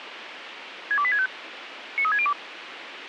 Five-tone selective call (ZVEI), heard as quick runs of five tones, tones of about 70 ms, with radio hiss and a squelch burst at the end. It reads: 62865 93602